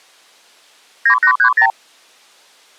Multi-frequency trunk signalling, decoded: 9830

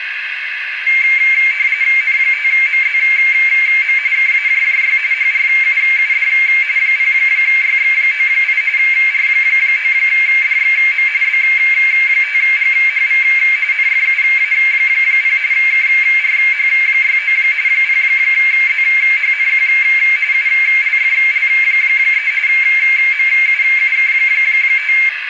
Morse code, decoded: none

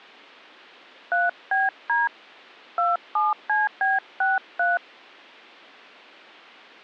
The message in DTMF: 3BD 27CB63

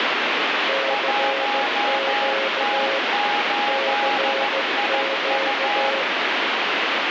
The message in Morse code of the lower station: CQ CQ

